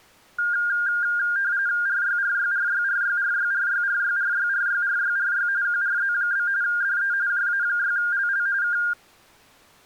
RTTY (45.45 baud, 170 Hz shift), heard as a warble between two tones, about 1500 Hz centre. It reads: RYRYRYRYRYRYRYRYRYRYRY QRZ? DE JA6LL K